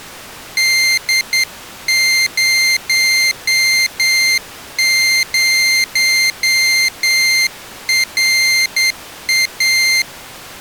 Morse code, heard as a high beeper, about 9 wpm, 2100 Hz. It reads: D00RA